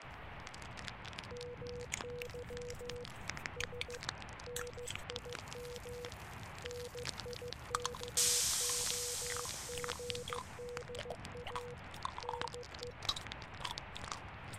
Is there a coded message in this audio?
Yes: Morse code (Russian alphabet) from 1.3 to 13.0 s, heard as a keyed tone, hand-sent with a paddle, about 15 wpm, 490 Hz, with radio static. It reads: МЫ С НИМ НИКОГДА НЕ